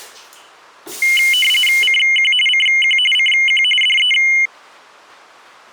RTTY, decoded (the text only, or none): CQ CQ CQ DE